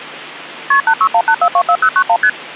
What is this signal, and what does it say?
Multi-frequency trunk signalling (R1, as on North American trunks), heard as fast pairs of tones, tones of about 70 ms. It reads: KP 8618424091 ST